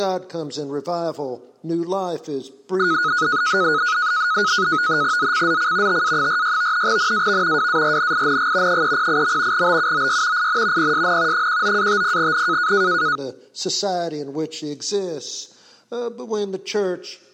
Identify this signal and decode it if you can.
NAVTEX (SITOR-B), 100 baud, 170 Hz shift, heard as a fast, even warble, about 1360 Hz centre. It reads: ZCZC TA46 NAV WARNING 308. BUOY IN PSN 19-50N